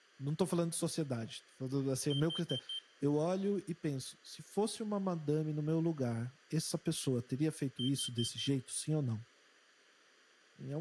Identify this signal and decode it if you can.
Alarm pattern, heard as an alarm's beeps, played twice, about 3150 Hz, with room echo and speech in Portuguese. Temporal four. Carbon monoxide.